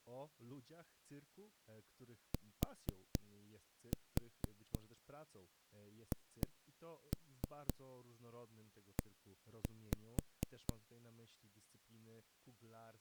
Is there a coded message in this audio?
Yes: tap code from 2.3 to 10.7 s, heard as knocks on a wall, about 4 knocks a second, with speech in Polish. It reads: THE